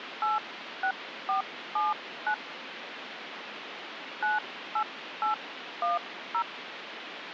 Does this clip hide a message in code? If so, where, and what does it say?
Yes: DTMF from 0.2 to 6.4 s, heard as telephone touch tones, dialled by hand, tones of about 140 ms, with phone line noise. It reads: 86479 98810